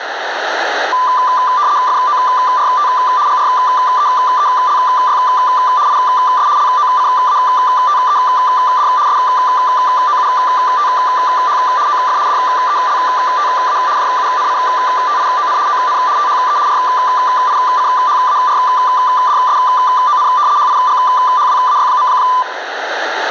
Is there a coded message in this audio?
Yes: RTTY (75 baud, 170 Hz shift) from 0.9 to 22.4 s, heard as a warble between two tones, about 1090 Hz centre, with radio static. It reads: FORT GREELY IS LOCATED SOUTH OF DELTA JUNCTION ON THE RICHARDSON HIGHWAY.